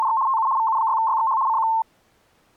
RTTY (75 baud, 170 Hz shift), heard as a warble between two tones, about 980 Hz centre. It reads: … TU VU6YXH CQ